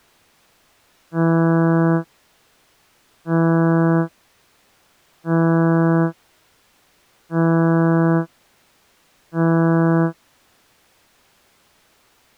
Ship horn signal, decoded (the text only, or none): 5 short